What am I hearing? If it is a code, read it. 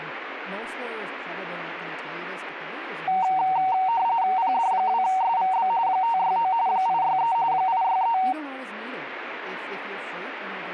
RTTY (45.45 baud, 170 Hz shift), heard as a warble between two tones, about 840 Hz centre, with speech in English. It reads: PD2SVB 569 863 863